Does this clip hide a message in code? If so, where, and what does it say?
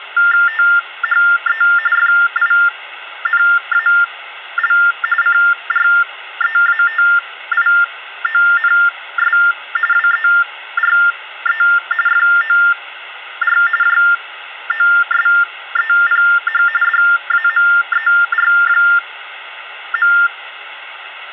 Yes: TTY/TDD text telephone tones (45.45 baud Baudot) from 0.2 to 20.3 s, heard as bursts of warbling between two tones, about 400 Hz shift, 1600 Hz centre, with phone line noise. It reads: THE FINAL CREATIONS WERE FOR JOSEPH DAMER.